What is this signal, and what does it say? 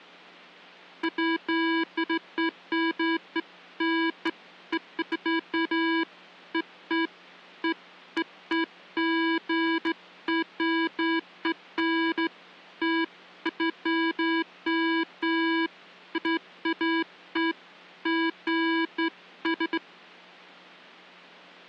Beeps of irregular length. There is no code.